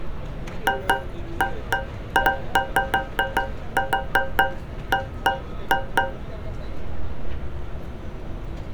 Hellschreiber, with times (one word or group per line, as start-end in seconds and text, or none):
none